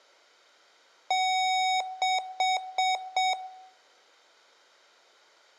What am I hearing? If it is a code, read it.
Beep code, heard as beeps from a small speaker, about 750 Hz, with room echo. 1 long, 4 short.